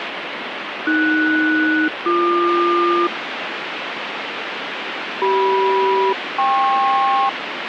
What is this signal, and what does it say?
Aircraft SELCAL, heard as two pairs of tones, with radio static. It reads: AS-BQ CM-KP